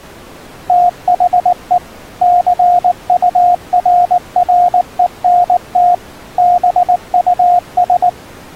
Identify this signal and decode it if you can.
Morse code, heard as a keyed tone, machine-sent, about 19 wpm, 710 Hz. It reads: THE CURRENT BUS